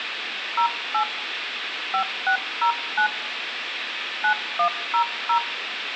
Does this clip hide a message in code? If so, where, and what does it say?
Yes: DTMF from 0.6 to 5.4 s, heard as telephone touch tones, dialled by hand, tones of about 90 ms, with phone line noise and room echo. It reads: 08 5609 9100